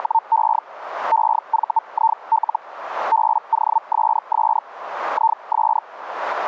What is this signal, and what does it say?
Hellschreiber (Feld-Hell, 122.5 baud), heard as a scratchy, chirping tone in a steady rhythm, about 900 Hz. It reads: … EVIL BOSS IS